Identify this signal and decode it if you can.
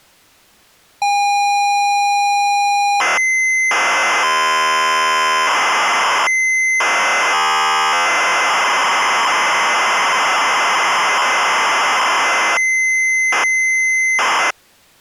ZX Spectrum tape loading, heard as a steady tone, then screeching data.